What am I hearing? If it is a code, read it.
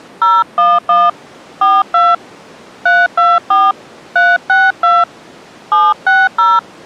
DTMF, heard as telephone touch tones, dialled by hand, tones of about 210 ms. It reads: 011 42 324 362 760